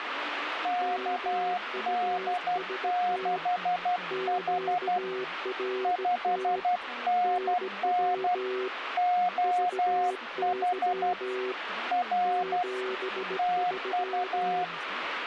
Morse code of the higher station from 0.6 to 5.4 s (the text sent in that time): KD6H